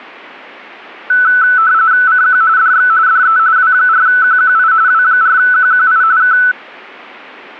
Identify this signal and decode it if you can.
RTTY (45.45 baud, 170 Hz shift), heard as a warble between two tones, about 1410 Hz centre. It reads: CQ DX DE W4QQI W4QQI K